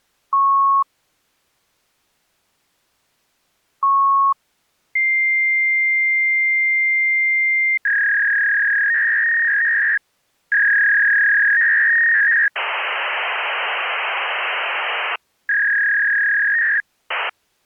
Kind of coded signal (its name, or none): fax machine handshake